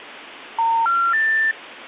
Telephone call progress tone (North American plan), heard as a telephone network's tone, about 910, 1370, 1800 Hz. Special information tone.